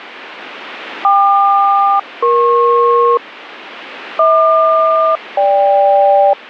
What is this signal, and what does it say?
Aircraft SELCAL, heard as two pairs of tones. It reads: KQ-EP HQ-GK